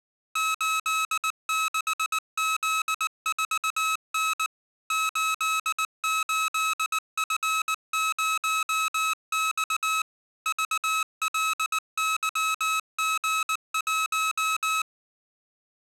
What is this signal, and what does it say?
Morse code, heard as electronic beeps, machine-sent, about 19 wpm, 1290 Hz. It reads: 86Z4N 88F0X VLYG1